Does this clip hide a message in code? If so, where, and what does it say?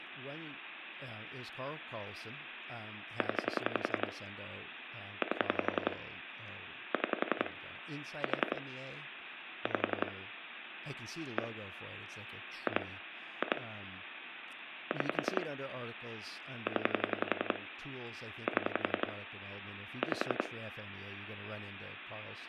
Yes: pulse dialling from 3.2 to 20.5 s, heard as clicks on a phone line, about 11 pulses a second, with phone line noise and speech in English. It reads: 0 8 6 4 5 1 2 2 6 0 7 5